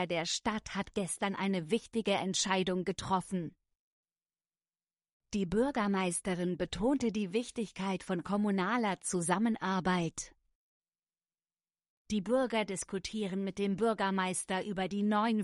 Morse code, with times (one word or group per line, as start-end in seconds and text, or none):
none